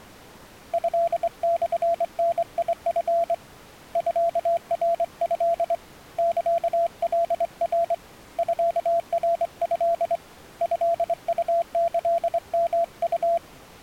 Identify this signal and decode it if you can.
Morse code (Japanese Wabun code), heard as a keyed tone, hand-sent with a straight key, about 24 wpm, 680 Hz. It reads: トモダチ ミナト サカナ ミナト トウキヨウ